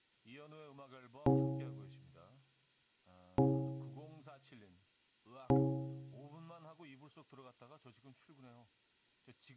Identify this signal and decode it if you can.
Clock strike, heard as a bell, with room echo and speech in Korean. 3. Three o'clock.